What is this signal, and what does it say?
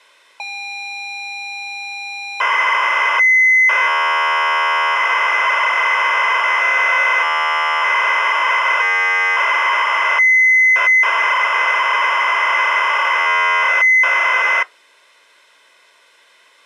ZX Spectrum tape loading, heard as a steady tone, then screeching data.